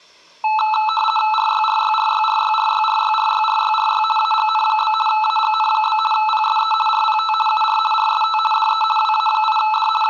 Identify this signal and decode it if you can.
RTTY (50 baud, 450 Hz shift), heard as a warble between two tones, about 1090 Hz centre, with room echo. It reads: RYRYRYRYRYRYRYRYRY AGN? AGN? PSE RPT UR RST DE WA8D …